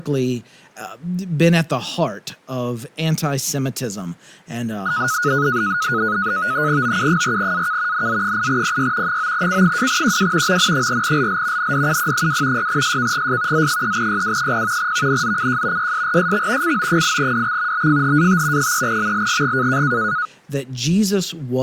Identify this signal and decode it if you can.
NAVTEX (SITOR-B), 100 baud, 170 Hz shift, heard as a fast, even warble, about 1360 Hz centre, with speech in English. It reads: OU4AK NZ8PY 9C2QW MN4LL NDUP2 6SKGS Z3YW0 VNZCJ YSRSX CO8DX BFHAT 3MLGG